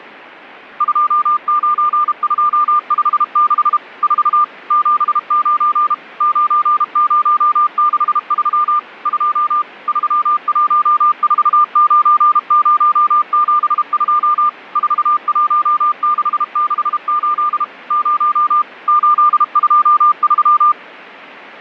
Morse code, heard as a keyed tone, machine-sent, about 32 wpm, 1200 Hz. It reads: 29256 4 79 9063 2 3149072 41668 0 823